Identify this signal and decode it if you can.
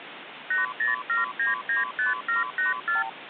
Multi-frequency trunk signalling (R2, with the far end's replies), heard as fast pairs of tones, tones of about 150 ms, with phone line noise. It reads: 807995784